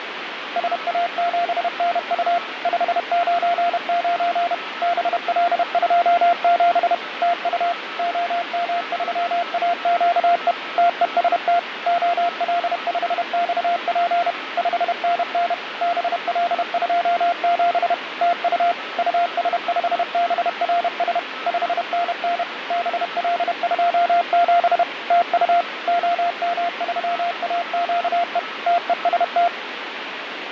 Morse code, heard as a keyed tone, machine-sent, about 31 wpm, 690 Hz, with radio static and a weaker station near 1300 Hz. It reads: SA7NU 599 BL27 TU OM3AQE TEST OL5XP 5NN BL27 TU US5BRS 5NN BL27 TU OM3AQE TEST